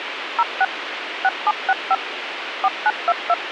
DTMF, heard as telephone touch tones, dialled by machine, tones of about 40 ms, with radio hiss. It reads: 06 6765 4922